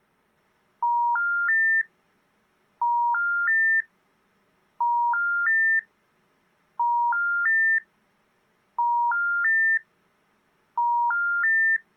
Telephone call progress tone (ITU plan), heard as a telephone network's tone, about 950, 1400, 1800 Hz. Special information tone.